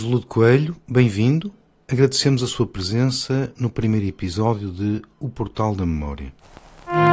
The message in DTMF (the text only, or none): none